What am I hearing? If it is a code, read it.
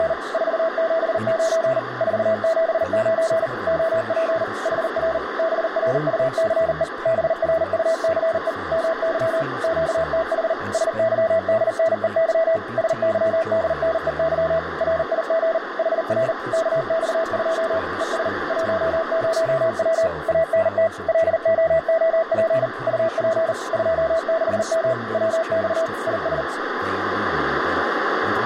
Morse code, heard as a keyed tone, machine-sent, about 39 wpm, 650 Hz, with radio static, a narrow filter and speech in English. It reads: … 479 479 OP HR BRUCE BRUCE MY QTH SYDNEY SYDNEY RIG HR KX2 ES 10W ANT LOOP UP 26M WX IS